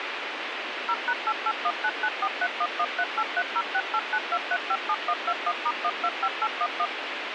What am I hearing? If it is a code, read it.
DTMF, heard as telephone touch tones, dialled by machine, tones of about 60 ms, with radio hiss. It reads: 0#88199431138306892357121*125811